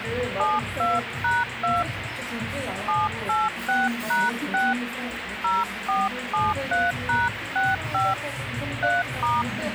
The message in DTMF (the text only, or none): 72#2 786#6 0473#65 3*